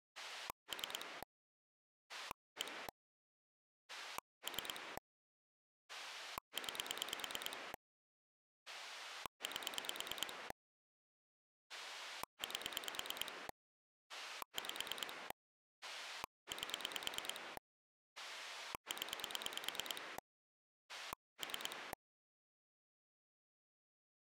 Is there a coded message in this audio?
Yes: pulse dialling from 0.2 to 21.9 s, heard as a rotary dial, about 9 pulses a second. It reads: 3 1 3 9 8 8 5 8 0 3